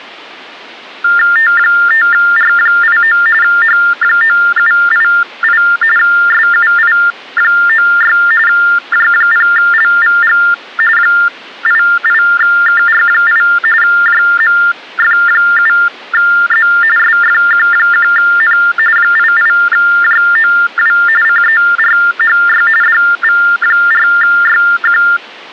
TTY/TDD text telephone tones (45.45 baud Baudot), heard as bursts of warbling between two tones, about 400 Hz shift, 1600 Hz centre. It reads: T5R89 H9788 SUI96 J0LVG 88KR8 JMF7Z SFQ1N 88JOW CERHY DV4YQ